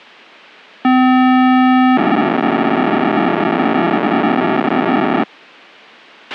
POCSAG pager data (512 baud), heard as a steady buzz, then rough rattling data, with a squelch burst at the end.